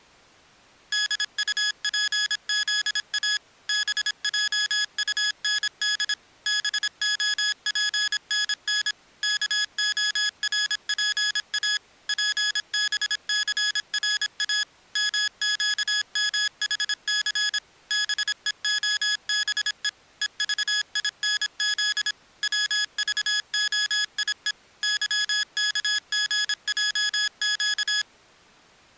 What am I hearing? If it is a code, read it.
Morse code, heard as electronic beeps, machine-sent, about 26 wpm, 1700 Hz. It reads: DUPZA BJUND BOPNN KORPA PBCRA MQMHC BEOBE EVINZ WVOIE YKGJQ